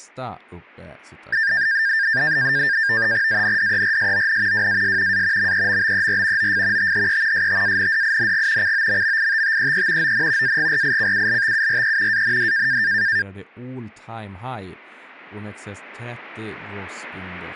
NAVTEX (SITOR-B), 100 baud, 170 Hz shift, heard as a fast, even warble, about 1700 Hz centre, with speech in Swedish. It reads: ANDERSON WAS A MEMBER OF THE STANDING COMMITTEE ON AGRICULTURE AND